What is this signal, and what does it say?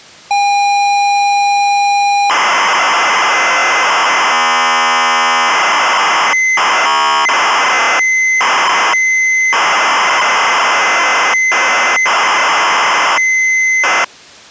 ZX Spectrum tape loading, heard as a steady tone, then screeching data.